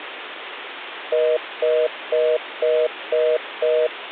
Telephone call progress tone (North American plan), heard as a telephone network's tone, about 480, 620 Hz, 0.25 s on and 0.25 s off, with phone line noise. Congestion tone.